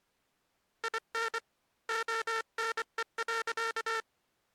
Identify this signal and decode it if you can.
Morse code, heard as a buzzer, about 24 wpm. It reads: IN ONE.